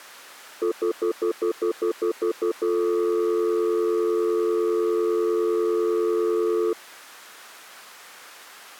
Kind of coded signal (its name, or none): telephone call progress tone